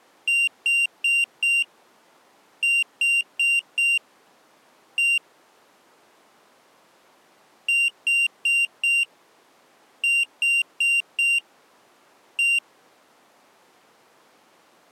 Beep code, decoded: 4-4-1

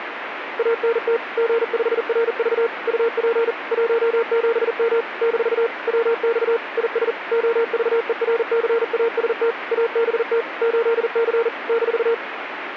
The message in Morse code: ANT G5RV UP 17M - WX IS OVERCAST ABT 8C -

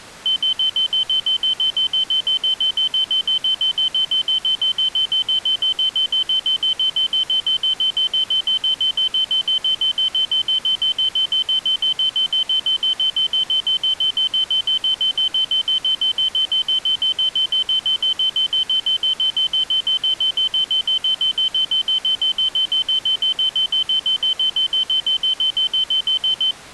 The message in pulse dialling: none

